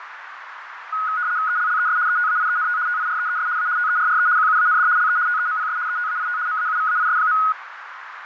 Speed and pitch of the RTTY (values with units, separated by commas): 75 baud, 170 Hz shift, 1360 Hz centre